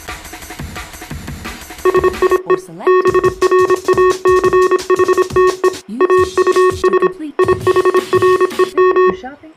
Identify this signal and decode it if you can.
Morse code, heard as electronic beeps, machine-sent, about 26 wpm, 370 Hz. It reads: SIE BRACHTE AUS IHREM